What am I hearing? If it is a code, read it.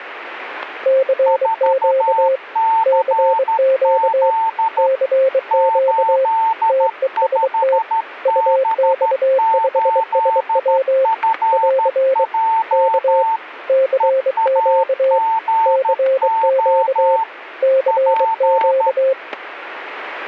Morse code, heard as two keyed tones, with static crashes. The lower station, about 23 wpm, 530 Hz: CQ CQ CQ TEST UX5SW <AR> K CQ CQ CQ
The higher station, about 13 wpm, 900 Hz: 4CZ 85B8FJ EAGO P